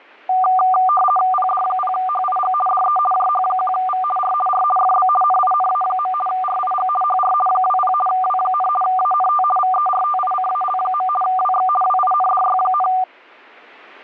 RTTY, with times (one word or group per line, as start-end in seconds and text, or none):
1.3-2.5 PD0HIG
2.7-3.0 DE
3.1-4.0 JH1V
4.2-4.3 R
4.5-4.6 R
4.8-5.1 FB
5.2-6.1 NINA.
6.3-6.9 RIG
7.0-7.3 HR
7.5-7.9 20
8.1-8.7 W,
8.8-9.4 ANT
9.6-11.1 VERTICAL.
11.2-11.7 WX
11.8-12.9 WINDY,